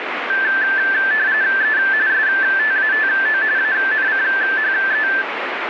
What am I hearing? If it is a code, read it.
RTTY (45.45 baud, 170 Hz shift), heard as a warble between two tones, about 1650 Hz centre, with radio static. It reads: E STATO ANCHE